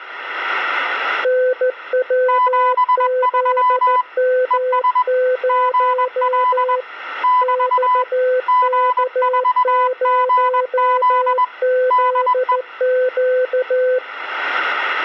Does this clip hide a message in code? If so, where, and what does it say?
Yes: Morse code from 1.2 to 14.0 s, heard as two keyed tones. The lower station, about 14 wpm, 510 Hz: NWZM0 XK0ZQ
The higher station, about 21 wpm, 1000 Hz: 73 ES GL <BT> G4GZ DE